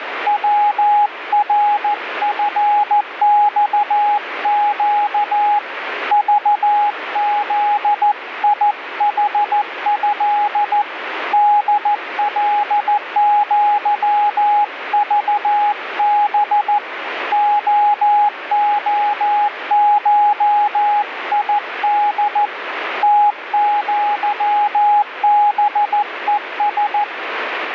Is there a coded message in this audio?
Yes: Morse code (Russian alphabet) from 0.2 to 27.1 s, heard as a keyed tone, hand-sent with a paddle, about 14 wpm, 830 Hz, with radio static. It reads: ВРФЬЩ ЖЗИХЭ ДЛЪЖБ ООШИД ТЪБЕС